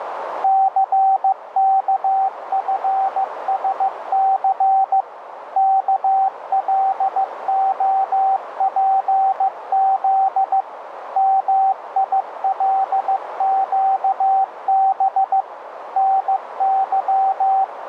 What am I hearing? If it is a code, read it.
Morse code, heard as a keyed tone, machine-sent, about 15 wpm, 770 Hz, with radio static and a narrow filter. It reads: CKFSC KLOPZ MILQB …